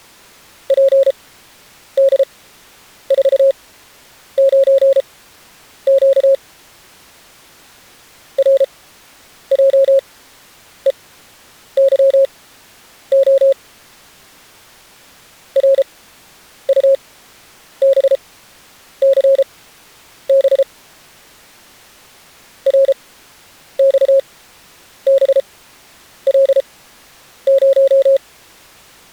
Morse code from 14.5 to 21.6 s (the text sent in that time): RUBCB